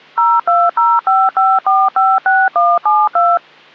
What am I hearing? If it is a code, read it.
DTMF, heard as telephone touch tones, dialled by machine, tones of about 220 ms. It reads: 02055456172